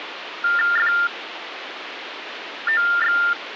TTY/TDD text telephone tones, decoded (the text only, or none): FOX